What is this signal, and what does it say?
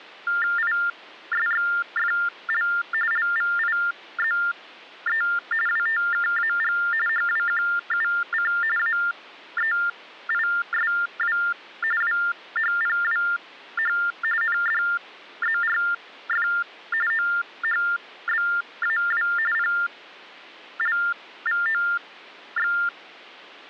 TTY/TDD text telephone tones (45.45 baud Baudot), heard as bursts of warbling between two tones, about 400 Hz shift, 1600 Hz centre. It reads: ISXFL LVIZE WTKAG HWQUC AEISW WHPWH NDZRF OHBAW PLVOX